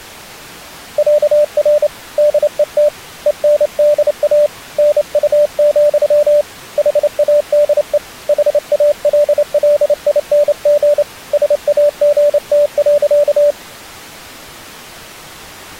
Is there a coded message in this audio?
Yes: Morse code (with Swedish letters) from 0.9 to 13.6 s, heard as a keyed tone, hand-sent with a straight key, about 28 wpm, 590 Hz. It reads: ÄR DET ENDA NU, HADE HALLING SAGT.